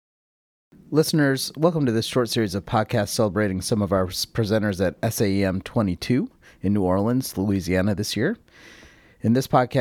Speech in English. There is no code.